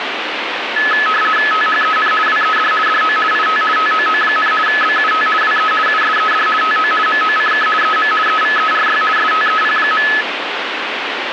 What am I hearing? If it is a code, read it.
RTTY (50 baud, 450 Hz shift), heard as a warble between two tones, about 1500 Hz centre, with radio static. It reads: THEN WED DO IT TOO, BUT WE USED TO MOCK EM EVERY STEP.